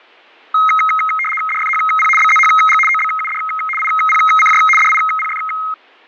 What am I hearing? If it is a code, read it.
RTTY (75 baud, 850 Hz shift), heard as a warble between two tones, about 1700 Hz centre. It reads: DFHP BZHG OBUD IPCJ DIPF